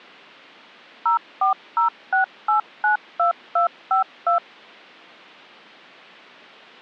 DTMF, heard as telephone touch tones, dialled by machine, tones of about 120 ms. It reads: 0406892252